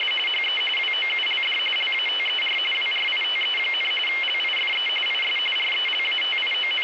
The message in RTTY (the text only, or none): … HE WOULD LATER WRITE, LIFE IS …